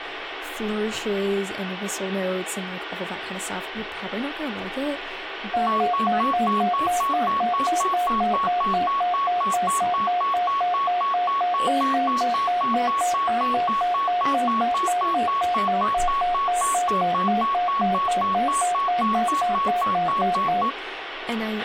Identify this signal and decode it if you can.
A tone that alternates evenly between two pitches, with radio hiss, a squelch burst at the end and speech in English. There is no code.